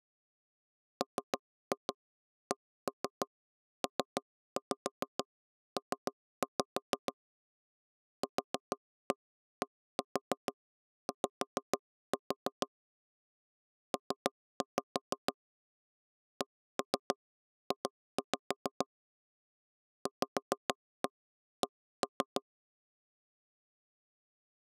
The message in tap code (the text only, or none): MCPP QDY P CJ VC